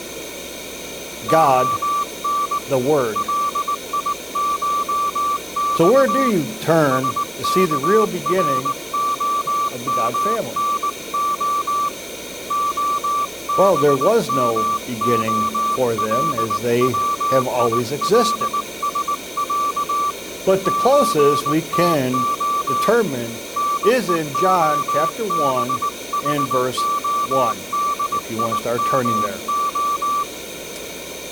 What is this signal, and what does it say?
Morse code (Russian alphabet), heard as a keyed tone, hand-sent with a paddle, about 19 wpm, 1160 Hz. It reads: ОН ЛИШЬ СКРОМНО ОБМОЛВИЛСЯ ЧТО НЕОБХОДИМО